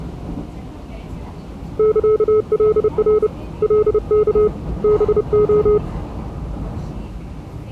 Morse code (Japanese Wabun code), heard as a keyed tone, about 30 wpm, 420 Hz, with the noise inside a subway train. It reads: サカナ カワ ハレ